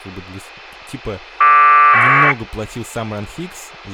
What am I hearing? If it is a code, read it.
Packet radio (AX.25, as in APRS), 1200 baud, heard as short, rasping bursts, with speech in Russian.